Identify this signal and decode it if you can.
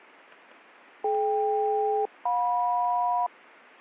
Aircraft SELCAL, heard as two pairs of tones. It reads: DK-JM